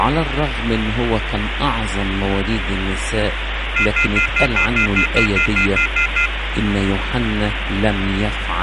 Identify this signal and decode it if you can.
Telephone call progress tone (North American plan), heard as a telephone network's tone, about 1400, 2050, 2450, 2600 Hz, 0.1 s on and 0.1 s off, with phone line noise. Off-hook warning tone.